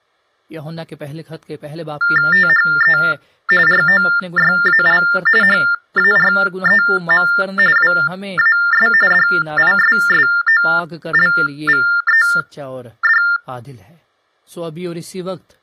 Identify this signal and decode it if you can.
TTY/TDD text telephone tones (45.45 baud Baudot), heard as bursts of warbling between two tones, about 400 Hz shift, 1600 Hz centre, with speech in Urdu. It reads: THE ROYAL HAREM WAS DISSOLVED